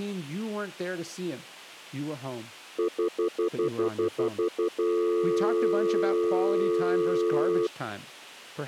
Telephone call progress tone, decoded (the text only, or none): stutter dial tone